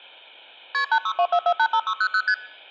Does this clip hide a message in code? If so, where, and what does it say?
Yes: multi-frequency trunk signalling (R1, as on North American trunks) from 0.7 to 2.3 s, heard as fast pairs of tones, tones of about 70 ms. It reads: KP 8624485600 ST